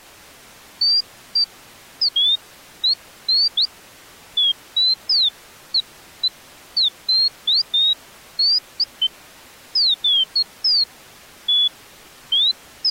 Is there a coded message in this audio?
No, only bird-like chirps.